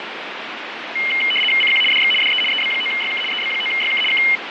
RTTY (75 baud, 850 Hz shift), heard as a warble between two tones, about 2550 Hz centre, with radio static. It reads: CQ DX DE EB9YK EB9YK K